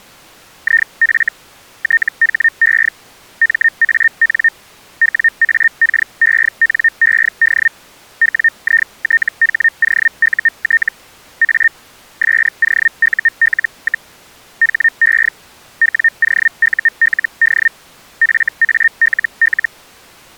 Hellschreiber (Feld-Hell, 122.5 baud), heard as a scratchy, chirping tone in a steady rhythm, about 1850 Hz. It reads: IF THE MAN WAKENED WITHOUT A SOUL, HE WOULD FALL